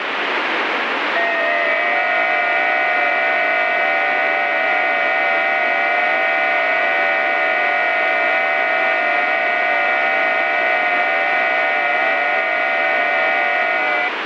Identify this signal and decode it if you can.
FT8 (several signals at once), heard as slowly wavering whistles, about 6.25 baud, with radio static.